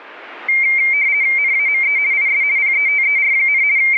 RTTY (50 baud, 170 Hz shift), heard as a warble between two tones, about 2200 Hz centre. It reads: NAME IS PETER, …